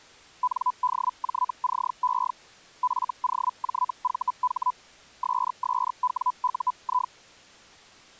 Hellschreiber (Feld-Hell, 122.5 baud), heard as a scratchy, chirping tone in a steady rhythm, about 1000 Hz. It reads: NDJCE FOJVH SSWUI